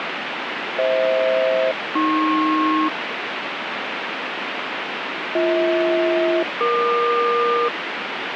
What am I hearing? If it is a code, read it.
Aircraft SELCAL, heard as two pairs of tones, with radio static. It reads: FH-AP BH-EQ